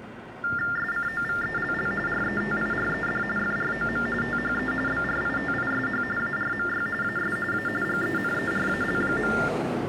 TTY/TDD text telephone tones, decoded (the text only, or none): SCOVELL RETIRED FROM THE BRITISH ARMY AS A GENERAL.